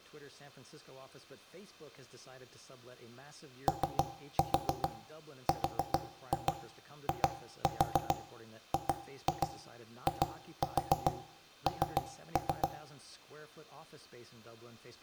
Tap code, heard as knocks on wood, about 7 knocks a second, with room echo and speech in English. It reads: ORIGIN